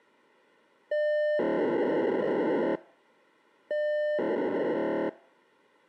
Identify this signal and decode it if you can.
POCSAG pager data (1200 baud), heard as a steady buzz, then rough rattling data.